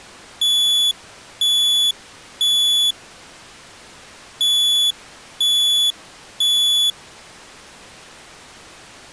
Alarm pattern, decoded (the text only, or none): temporal three